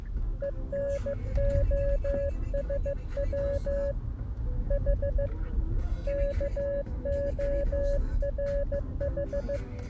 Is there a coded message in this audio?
Yes: Morse code (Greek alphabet) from 0.4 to 9.6 s, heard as a keyed tone, hand-sent with a paddle, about 15 wpm, 560 Hz, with the noise inside a car. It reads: ΕΝΟΣΩ Η ΚΟΡΗ